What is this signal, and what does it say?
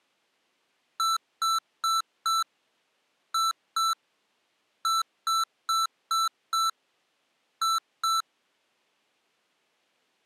Beep code, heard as beeps from a small speaker, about 1330 Hz. 4-2-5-2.